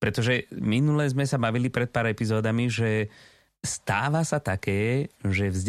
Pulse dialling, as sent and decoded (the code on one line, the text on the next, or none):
none